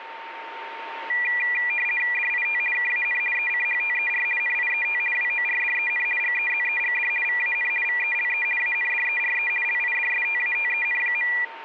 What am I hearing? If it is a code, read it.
RTTY (50 baud, 450 Hz shift), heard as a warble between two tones, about 2200 Hz centre, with radio static and a steady whistle near 910 Hz. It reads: DIT KAN ECHTER NIET WORDEN GEZEGD VAN VELE ANDERE LIDSTATEN.